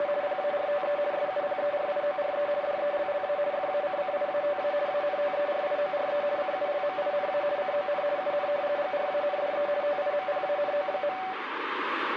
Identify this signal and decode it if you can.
RTTY (50 baud, 170 Hz shift), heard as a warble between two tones, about 670 Hz centre, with radio static. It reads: … PARTE SUPERIORE DELLA FACCIATA ANTERIORE CULMINA CON UN GRANDE TIMPANO.